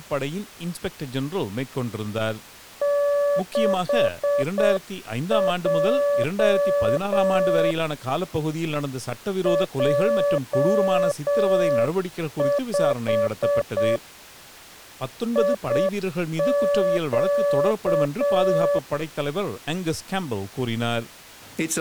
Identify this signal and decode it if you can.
Morse code, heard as a keyed tone, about 7 wpm, 570 Hz. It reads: 6J J5 IQ